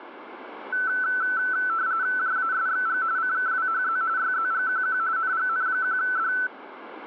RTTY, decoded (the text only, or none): JASXG CKWHZ YZGQQ NGN1D